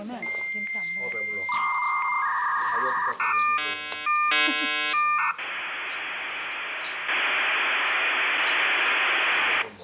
Dial-up modem handshake (V.34 or later), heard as a whistle, warbles, then hiss, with room echo and the noise of a restaurant.